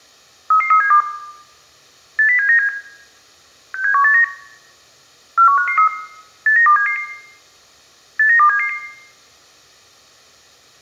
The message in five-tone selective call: 33372 80797 67189 41553 89277 89277

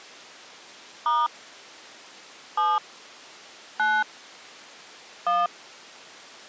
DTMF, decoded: * 7 9 1

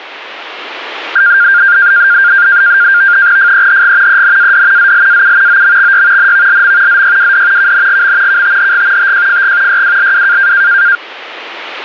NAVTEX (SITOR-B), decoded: FEHG ENAD ZLAU OMXY NVLM ZYWD KNGM KTHG TJFG YWLW

